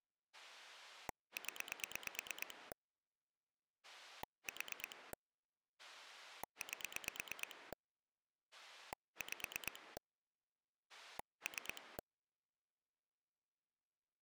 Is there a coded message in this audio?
Yes: pulse dialling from 0.3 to 12.0 s, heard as a rotary dial, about 8 pulses a second. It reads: 0 4 8 5 3